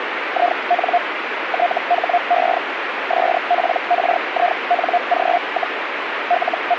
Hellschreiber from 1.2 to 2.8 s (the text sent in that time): THE